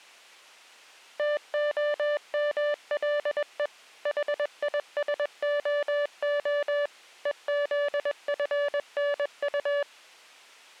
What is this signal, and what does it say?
Morse code, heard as a keyed tone, machine-sent, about 21 wpm, 580 Hz. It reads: TOMLE HISOO EZFNU